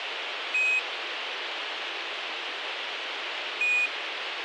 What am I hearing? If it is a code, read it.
Quindar tones, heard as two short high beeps, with radio hiss.